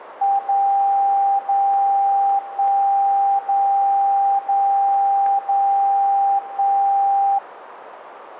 Radio time signal (DCF77), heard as a tone whose level steps once a second, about 790 Hz, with radio static. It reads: 0 0 1 0 0 0 1